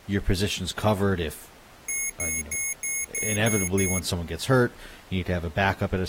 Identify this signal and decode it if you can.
Beep code, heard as beeps from a small speaker, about 2200 Hz, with speech in English. 7 short. In AMI BIOS tables: virtual mode exception error; in Dell tables: processor failure.